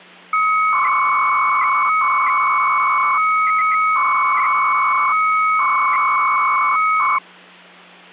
300-baud modem data (Bell 103 tones), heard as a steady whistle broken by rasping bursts, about 300 baud, 200 Hz shift, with hum.